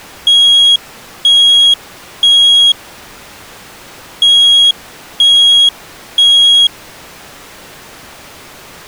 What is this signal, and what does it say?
Alarm pattern, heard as an alarm's beeps, played twice, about 3300 Hz. Temporal three. Smoke or fire, evacuate.